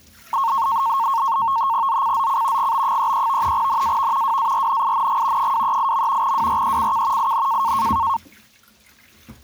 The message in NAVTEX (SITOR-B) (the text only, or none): ZCZC GB33 NAV WARNING 238. WRECK IN